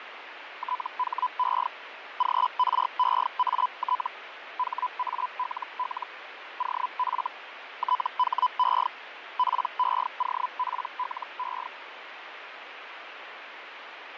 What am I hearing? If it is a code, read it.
Hellschreiber (Feld-Hell, 122.5 baud), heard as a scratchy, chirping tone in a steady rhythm, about 1000 Hz, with radio static and fading. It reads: THE GREAT HALL OF THE PEOPLE